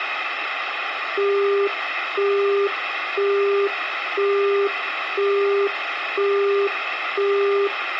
Telephone call progress tone (single-tone plan, as in Europe, Japan and elsewhere), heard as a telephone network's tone, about 400 Hz, 0.5 s on and 0.5 s off, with phone line noise. Busy tone.